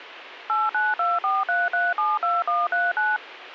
DTMF, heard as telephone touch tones, dialled by machine, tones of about 200 ms, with radio hiss. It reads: 89243372139